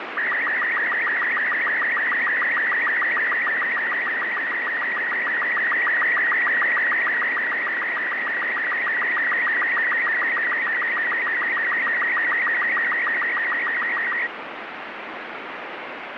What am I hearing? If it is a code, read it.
SSTV (slow-scan television), Robot 36, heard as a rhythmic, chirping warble, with radio static.